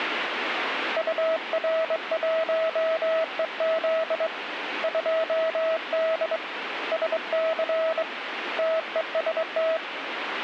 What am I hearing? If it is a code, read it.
Morse code, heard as a keyed tone, hand-sent with a straight key, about 22 wpm, 650 Hz, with radio static. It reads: UR1EZ 2D SC TEST